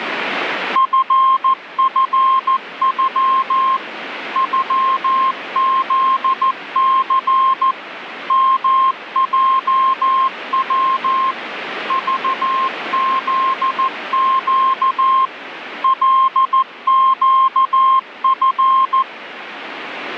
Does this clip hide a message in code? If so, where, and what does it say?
Yes: Morse code (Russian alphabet) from 0.7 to 19.1 s, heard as a keyed tone, machine-sent, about 14 wpm, 1060 Hz, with radio static. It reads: ФФЮ ЮЗЦ МЙВ ЖЗЩ ЛЩФ